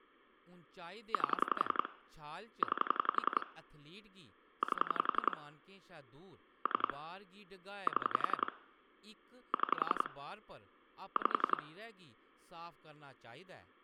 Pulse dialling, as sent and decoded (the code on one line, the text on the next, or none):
8 / 9 / 8 / 3 / 7 / 6 / 5
8 9 8 3 7 6 5